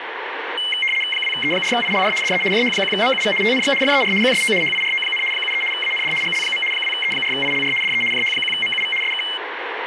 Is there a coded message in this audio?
Yes: RTTY (75 baud, 850 Hz shift) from 0.6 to 9.4 s, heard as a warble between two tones, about 2550 Hz centre, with radio static and speech in English. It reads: 2E4ILR DE JH1MUV TNX FER QSO HIRO, 73 AND GL. 2E4ILR DE JH1MUV SK